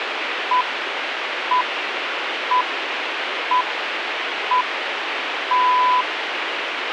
Radio time signal (six pips, as the Greenwich Time Signal), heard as pips, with radio hiss.